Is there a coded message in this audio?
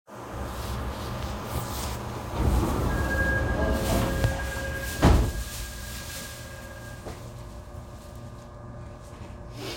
No, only the noise inside a subway train.